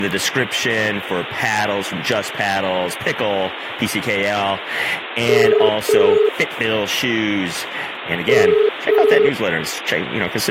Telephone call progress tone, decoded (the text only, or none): ringback tone